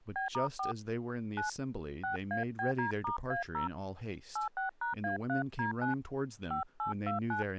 DTMF, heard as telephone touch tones, dialled by hand, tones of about 120 ms, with speech in English. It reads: B*4 9 6ABD*A0 86#A3D9 5829